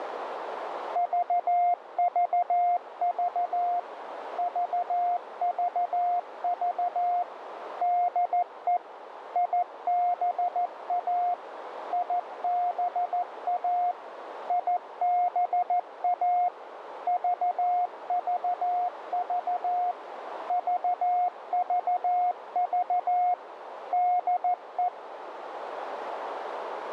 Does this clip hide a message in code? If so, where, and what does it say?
Yes: Morse code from 0.9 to 24.9 s, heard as a keyed tone, machine-sent, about 14 wpm, 710 Hz, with radio static and a narrow filter. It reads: VVV VVV DE IBA IBA IBA VVV VVV DE